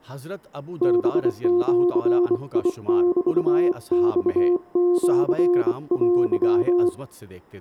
Morse code (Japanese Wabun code), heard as a keyed tone, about 24 wpm, 350 Hz, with room echo and speech in Urdu. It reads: ハジメマシテ